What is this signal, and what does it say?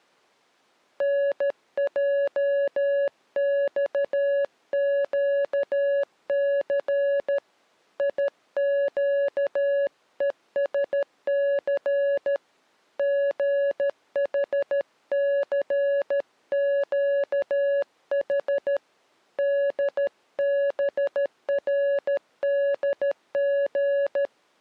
Morse code, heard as a keyed tone, hand-sent with a paddle, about 13 wpm, 560 Hz. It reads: NJXQC IQESC GHCQH DBRDG